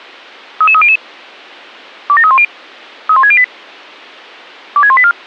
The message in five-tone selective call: 33300 27310 31608 26184

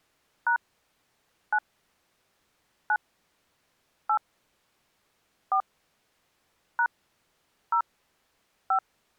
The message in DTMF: # 9 9 8 4 # 0 5

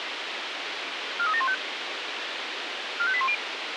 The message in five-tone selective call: 43715 45810

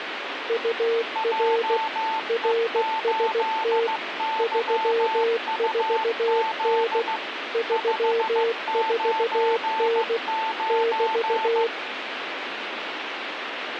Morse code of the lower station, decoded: UR RST 34N 34N <BT>

